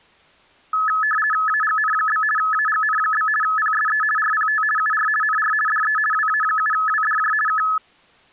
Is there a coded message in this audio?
Yes: RTTY (50 baud, 450 Hz shift) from 0.7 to 7.8 s, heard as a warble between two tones, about 1500 Hz centre. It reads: AGN? AGN? PSE RPT UR NR DE WA7WDJ K